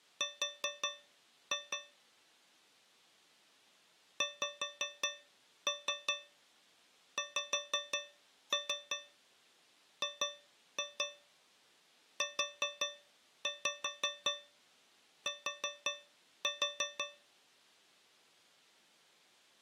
Tap code, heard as taps on a metal pipe, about 5 knocks a second. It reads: R XXGUT